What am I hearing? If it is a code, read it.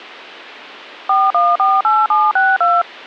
DTMF, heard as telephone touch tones, dialled by machine, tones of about 210 ms. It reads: 4148762